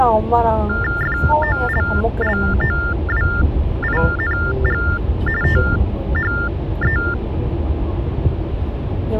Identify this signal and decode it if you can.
TTY/TDD text telephone tones (45.45 baud Baudot), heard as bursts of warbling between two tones, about 400 Hz shift, 1600 Hz centre, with the noise inside a car. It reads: FOLLOWING THE